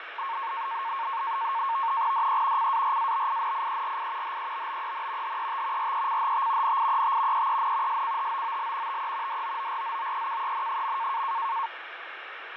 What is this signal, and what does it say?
NAVTEX (SITOR-B), 100 baud, 170 Hz shift, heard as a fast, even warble, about 1000 Hz centre, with radio static and fading. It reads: DE CARABINIERI HEBBEN HET RECHT NIET EEN SCHOOL TE DOORZOEKEN.